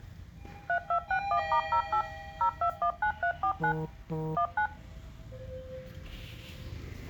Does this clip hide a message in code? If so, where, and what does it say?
Yes: DTMF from 0.7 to 4.7 s, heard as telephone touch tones, dialled by machine, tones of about 90 ms, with the noise inside a lift. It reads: 3261*08 0219349 19